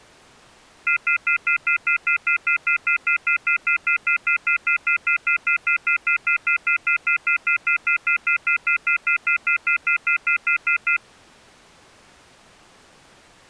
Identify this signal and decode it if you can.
Telephone call progress tone (North American plan), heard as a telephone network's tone, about 1400, 2050, 2450, 2600 Hz, 0.1 s on and 0.1 s off. Off-hook warning tone.